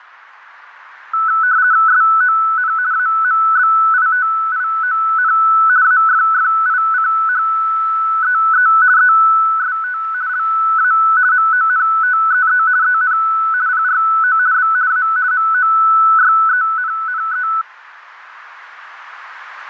RTTY (50 baud, 170 Hz shift), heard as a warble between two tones, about 1400 Hz centre. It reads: SON AMBITION AFFICHEE EST LA MONTEE EN PRO B A MOYENNE